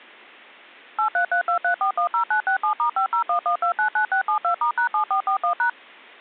DTMF, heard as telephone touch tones, dialled by machine, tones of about 100 ms. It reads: 83323410967*5011299672*#7441#